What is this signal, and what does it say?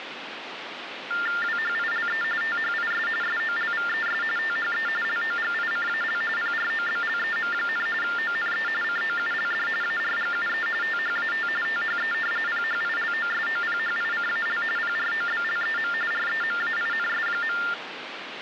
TTY/TDD text telephone tones (45.45 baud Baudot), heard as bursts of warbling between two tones, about 400 Hz shift, 1600 Hz centre, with phone line noise. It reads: WHILE THIS SOLVES THE LOGICAL PROBLEM, ONE COULD ARGUE THAT THE PHILOSOPHICAL PROBLEM REMAINS.